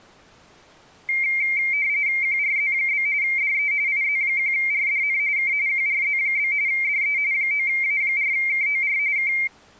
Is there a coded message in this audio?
Yes: RTTY (45.45 baud, 170 Hz shift) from 1.1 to 9.5 s, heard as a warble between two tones, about 2200 Hz centre. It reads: QRZ? DE IZ1RDN K QRZ? DE 9A4KOR K